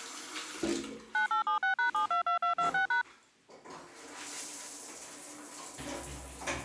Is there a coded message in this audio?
Yes: DTMF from 1.1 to 3.0 s, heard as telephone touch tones, dialled by machine, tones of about 110 ms, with the noise of a restroom. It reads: 9876#722226#